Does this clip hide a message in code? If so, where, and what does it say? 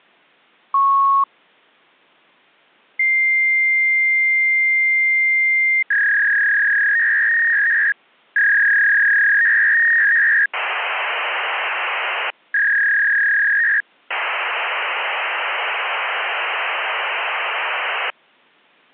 Yes: fax machine handshake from 0.7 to 18.1 s, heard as a beep, a long tone, a warble and hiss.